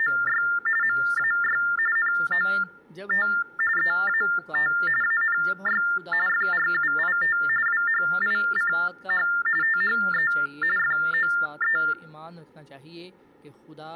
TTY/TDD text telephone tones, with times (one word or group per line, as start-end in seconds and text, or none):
0.0-0.4 …
0.8-1.6 MAY
2.0-3.3 NOT
3.8-4.7 EAT
5.0-5.8 ANY
6.3-7.4 FRUIT
7.7-9.3 WHICH
9.6-10.3 THE
10.8-11.8 FOE